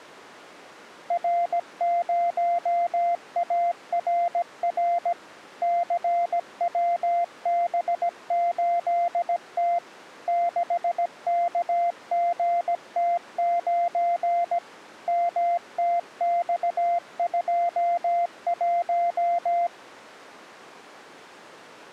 Morse code, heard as a keyed tone, machine-sent, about 17 wpm, 690 Hz. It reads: R0ARR CWB8T 6KGT9 MTX21